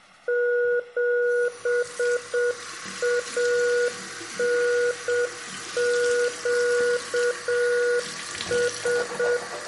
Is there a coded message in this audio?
Yes: Morse code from 0.2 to 9.4 s, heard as a keyed tone, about 7 wpm, 480 Hz, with room echo and the noise of a restroom. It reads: 7ANQS